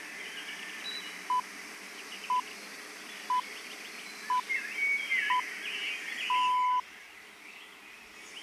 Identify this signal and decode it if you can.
Radio time signal (six pips, as the Greenwich Time Signal), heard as pips, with the noise of a park.